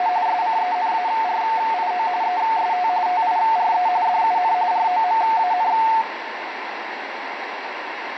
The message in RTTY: … SCENARIO EST TIRE DUN ROMAN

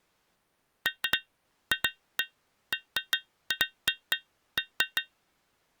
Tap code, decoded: none

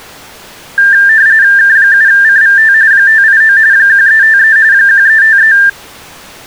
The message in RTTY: K7CVT 589 1353 1353

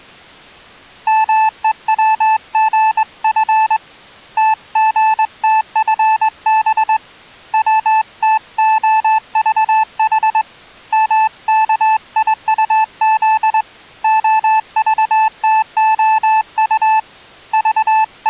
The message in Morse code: MEWGF TGTFB WTOVH MKIUZ OVTOU …

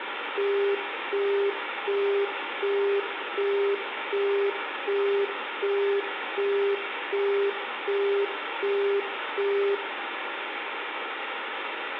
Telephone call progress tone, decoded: busy tone

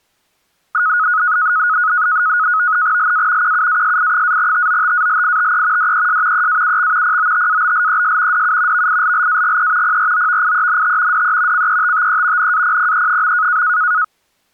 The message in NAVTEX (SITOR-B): LA QUASI-TOTALITE DES EAUX POTABLES DU VILLAGE PROVIENT DE CETTE NAPPE.

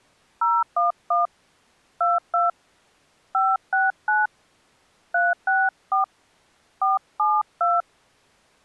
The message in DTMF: 011 22 569 364 472

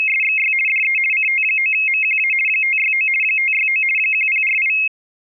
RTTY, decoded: … DE CT9MQA 569 569 1048

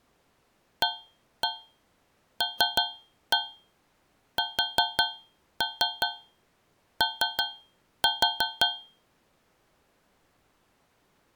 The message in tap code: ALSO

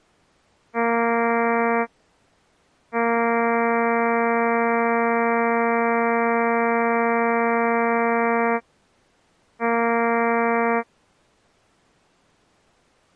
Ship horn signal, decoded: 1 short, 1 long, 1 short

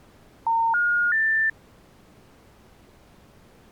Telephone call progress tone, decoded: special information tone

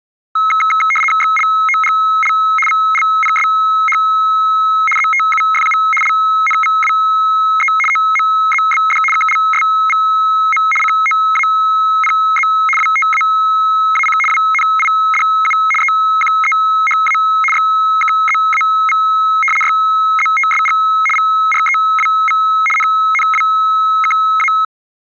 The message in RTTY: XLOGL VLPSH ZTUFU LNVWE OMZBD KLSVM COAPZ WTAAC WNIDU EQEHA XKZAV YZTSG VREWV NNWKA

